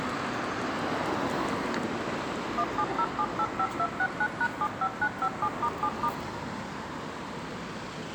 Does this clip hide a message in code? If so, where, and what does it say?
Yes: DTMF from 2.6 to 6.1 s, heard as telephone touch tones, dialled by machine, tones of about 60 ms, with street noise. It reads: 170785269#75957*7*